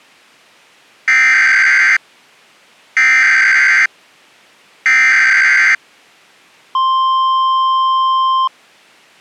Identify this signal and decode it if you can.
Emergency Alert System (SAME) tones (header bursts, then the 1050 Hz attention tone), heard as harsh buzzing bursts, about 520.83 baud.